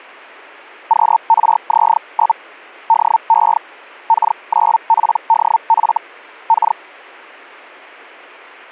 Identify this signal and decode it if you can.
Hellschreiber (Feld-Hell, 122.5 baud), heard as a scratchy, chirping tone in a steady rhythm, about 900 Hz. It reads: QRZ? DE K9PDF K